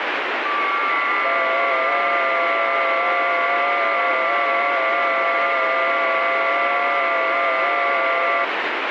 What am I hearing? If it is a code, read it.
FT8 (several signals at once), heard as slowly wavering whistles, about 6.25 baud, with heavy radio static.